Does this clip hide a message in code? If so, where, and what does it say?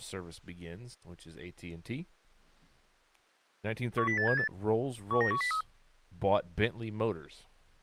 Yes: five-tone selective call (CCIR) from 4.0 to 5.6 s, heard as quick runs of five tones, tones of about 100 ms, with speech in English. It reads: 10878 19103